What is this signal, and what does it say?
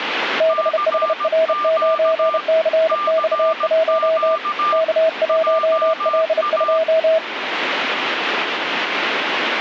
Morse code, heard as two keyed tones, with radio static. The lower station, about 31 wpm, 640 Hz: BHR9CX1 K1L2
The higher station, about 17 wpm, 1190 Hz: CQ CQ JA